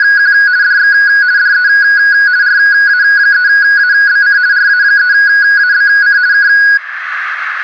RTTY (50 baud, 170 Hz shift), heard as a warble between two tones, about 1550 Hz centre, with radio static and room echo. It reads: … DX DE RA3ABC RA3ABC K